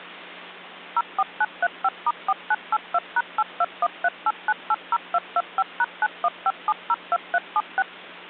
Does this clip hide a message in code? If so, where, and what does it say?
Yes: DTMF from 1.0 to 7.8 s, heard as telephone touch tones, dialled by machine, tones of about 40 ms, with hum. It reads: 04935*4982#82138980225#915702376